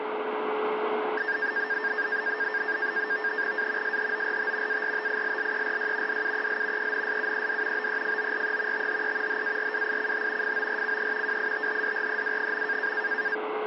NAVTEX (SITOR-B), 100 baud, 170 Hz shift, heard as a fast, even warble, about 1700 Hz centre, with radio static and a steady whistle near 430 Hz. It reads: A SHORT ARTILLERY DUEL ENSUED BEFORE THE HARWICH FORCE WITHDREW.